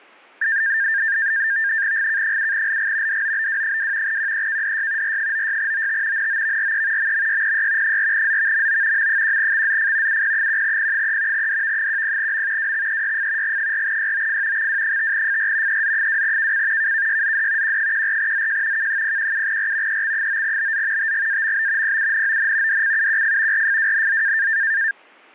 NAVTEX (SITOR-B), 100 baud, 170 Hz shift, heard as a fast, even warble, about 1700 Hz centre. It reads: GK7LG DOBW2 QEKDY R96OT NOVRE MMYPY 4ZVMO M1XZF UP1P3 DV10M WXEYF G4YOF XW5FR EZ2KC KKYZD Q14ZJ K017R EX9BZ TGAMB PUNON DCUQF RFWNZ